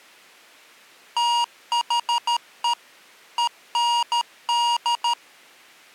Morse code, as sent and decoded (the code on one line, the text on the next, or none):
- .... . / . -. -..
THE END